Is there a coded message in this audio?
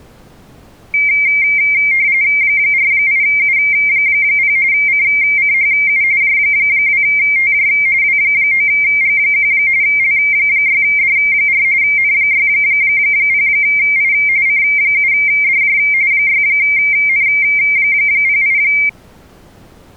Yes: RTTY (45.45 baud, 170 Hz shift) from 0.9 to 18.9 s, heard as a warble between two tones, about 2200 Hz centre. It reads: 48U0 CCHU J2TJ W9G1 L6D4 N60I C7DJ 6N08